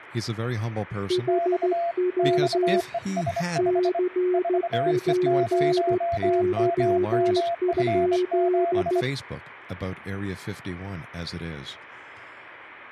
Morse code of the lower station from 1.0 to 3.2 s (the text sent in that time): HW